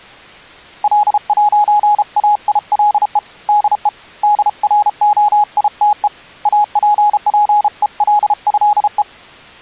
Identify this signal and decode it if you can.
Morse code (with French letters), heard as a keyed tone, hand-sent with a paddle, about 33 wpm, 830 Hz. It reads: L'AILE DE DROITE APPELÉE